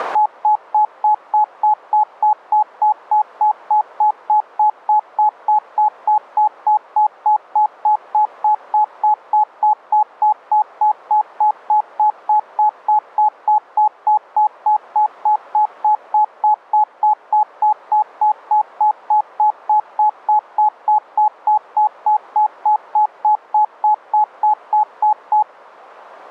Evenly repeated beeps. There is no code.